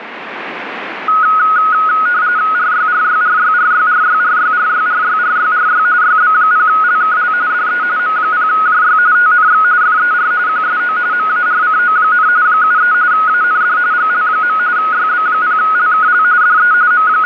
RTTY (45.45 baud, 170 Hz shift), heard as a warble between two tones, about 1360 Hz centre, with radio static. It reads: RYRYRYRYRYRYRYRYRYRY YB0LKL DE M0JY TNX FER QSO MARCO, 73 AND GL. YB0LKL DE …